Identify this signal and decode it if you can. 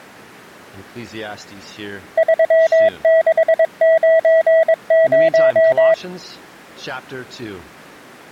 Morse code, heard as a keyed tone, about 22 wpm, 650 Hz. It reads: 3690